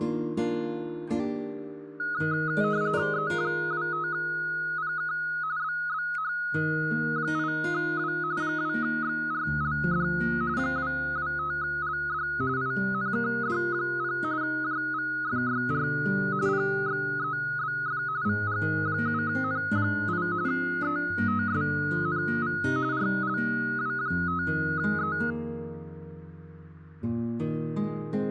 RTTY (45.45 baud, 170 Hz shift), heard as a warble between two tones, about 1360 Hz centre. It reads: E25PK BBH8W 2XRLD 225LD INKD0 JVFYR PXEBF VG7N8 ETSNV RLW5E